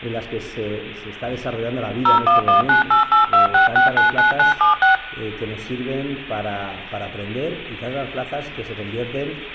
DTMF, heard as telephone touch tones, dialled by machine, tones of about 130 ms, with room echo. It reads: 01198826699976